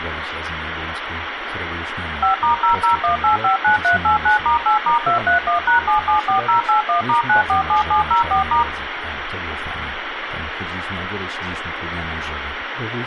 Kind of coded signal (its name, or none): DTMF